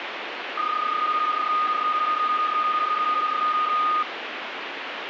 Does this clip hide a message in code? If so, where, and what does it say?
Yes: PSK31 (31.25 baud) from 0.6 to 4.0 s, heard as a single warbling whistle, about 1230 Hz, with radio static.